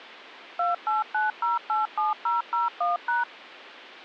DTMF, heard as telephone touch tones, dialled by machine, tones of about 160 ms. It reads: 289087001#